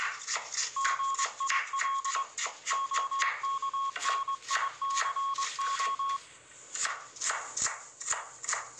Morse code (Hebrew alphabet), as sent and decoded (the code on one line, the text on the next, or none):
--. .. .-.. / --- -.- -. .. -.-. ---
גיל הכניסה